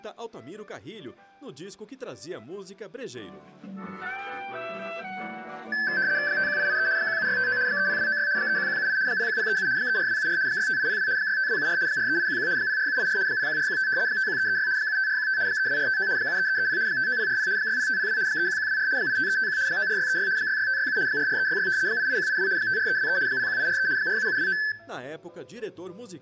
RTTY (75 baud, 170 Hz shift), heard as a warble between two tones, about 1650 Hz centre, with room echo. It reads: 51883 17659 30296 31178 01037 34274 65802 65274 43811 04784 01415 51336 75415 32459 73330 59040 60502 31124 85351 94636 66567 44366 88182 54323 01843 47729